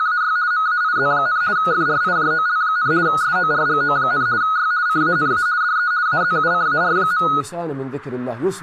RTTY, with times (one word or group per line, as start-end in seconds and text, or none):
0.0-0.4 …
0.5-1.4 MAIZ,
1.6-2.9 FRIJOL,
3.1-4.3 SORGO,
4.4-4.7 Y
4.9-5.5 CANA
5.6-5.9 DE
6.1-7.3 AZUCAR.